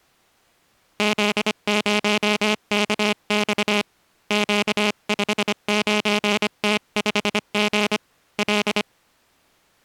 Morse code, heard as a buzzer, hand-sent with a paddle, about 25 wpm. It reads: Z0KX Q59T5G L